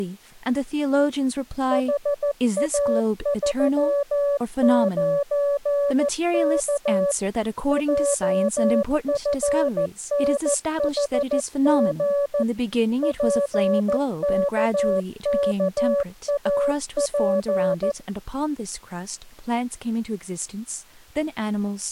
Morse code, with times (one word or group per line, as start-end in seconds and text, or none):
1.7-7.1 HA39K
7.7-12.4 JFNHG
13.0-17.9 PKKAP